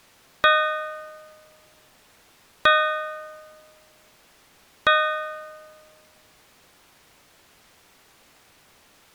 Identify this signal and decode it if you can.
Clock strike, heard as a bell. 3. Three o'clock.